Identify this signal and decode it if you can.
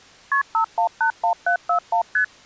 Multi-frequency trunk signalling (R1, as on North American trunks), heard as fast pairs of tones, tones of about 100 ms. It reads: KP 5181741 ST